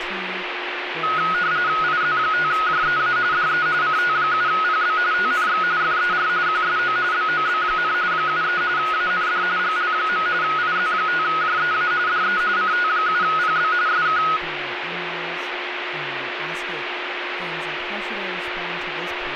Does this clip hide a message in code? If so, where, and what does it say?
Yes: RTTY (45.45 baud, 170 Hz shift) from 1.0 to 14.4 s, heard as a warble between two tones, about 1360 Hz centre, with radio static, a steady whistle near 360 Hz and speech in English. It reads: IZ5JEA DE CT7PB TNX FER QSO BOB, 73 AND GL. IZ5JEA DE CT7PB SK